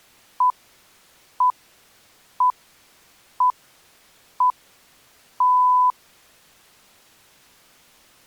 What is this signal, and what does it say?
Radio time signal (six pips, as the Greenwich Time Signal), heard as pips.